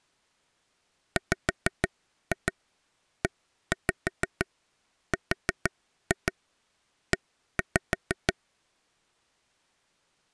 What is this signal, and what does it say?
Tap code, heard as taps on a table, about 6 knocks a second. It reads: WERE